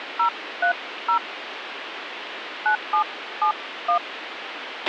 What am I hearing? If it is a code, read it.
DTMF, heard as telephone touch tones, dialled by hand, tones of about 100 ms, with radio hiss and a squelch burst at the end. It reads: 030 9771